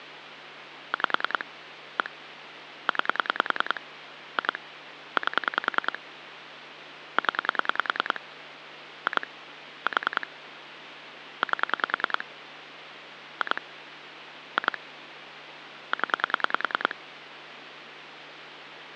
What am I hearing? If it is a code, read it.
Pulse dialling, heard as clicks on a phone line, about 10 pulses a second, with phone line noise. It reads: 5 1 9 2 8 0 2 4 8 2 2 0